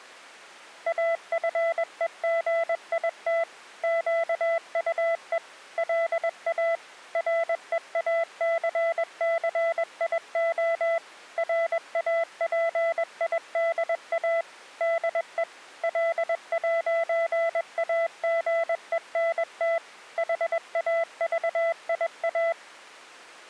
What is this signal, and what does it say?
Morse code, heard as a keyed tone, machine-sent, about 21 wpm, 670 Hz. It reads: AFEGIT QUE LA REACCIO RAPIDA DE L'AGENT HAVIA